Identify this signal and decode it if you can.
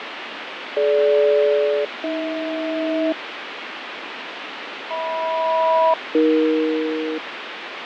Aircraft SELCAL, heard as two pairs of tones, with radio static and fading. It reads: DG-AH HM-AE